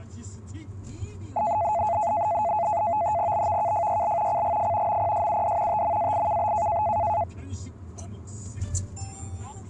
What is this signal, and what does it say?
NAVTEX (SITOR-B), 100 baud, 170 Hz shift, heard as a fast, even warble, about 770 Hz centre, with the noise inside a car. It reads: BVKFYL CGF MPSUD TMAIKB